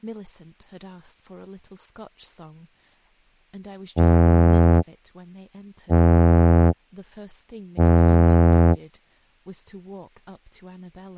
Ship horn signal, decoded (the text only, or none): 3 short